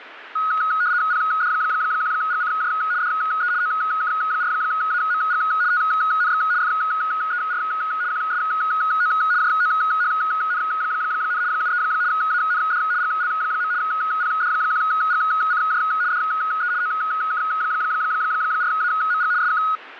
RTTY (75 baud, 170 Hz shift), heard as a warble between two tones, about 1360 Hz centre, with radio static. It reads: PD1GCJ DE OK4AMG TNX FER QSO JOHN, 73 AND GL. PD1GCJ DE OK4AMG SK